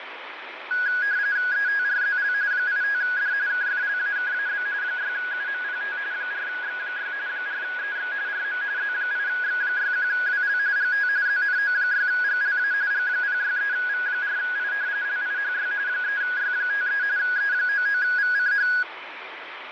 RTTY (45.45 baud, 170 Hz shift), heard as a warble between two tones, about 1550 Hz centre, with radio static and fading. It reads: ETRZL 85D KFLAKAB 6UMPT 4X6 4EX RM Z8X61WL GT ZNO6GLA G063V4I LIHY 3Y53 E99VCH